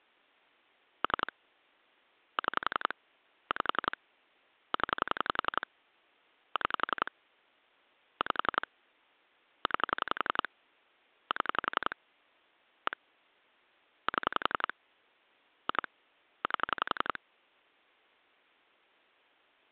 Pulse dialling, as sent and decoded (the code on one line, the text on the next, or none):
3 / 6 / 5 / 10 / 6 / 5 / 9 / 7 / 1 / 7 / 2 / 8
3 6 5 0 6 5 9 7 1 7 2 8